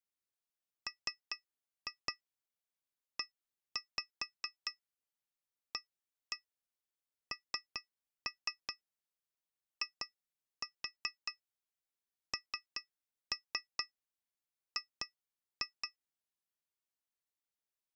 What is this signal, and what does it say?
Tap code, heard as taps on glass, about 4 knocks a second. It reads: MEANING